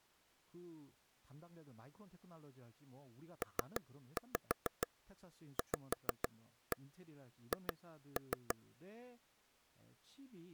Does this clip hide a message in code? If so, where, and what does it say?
Yes: tap code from 3.4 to 8.5 s, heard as taps on a table, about 6 knocks a second, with speech in Korean. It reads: PVH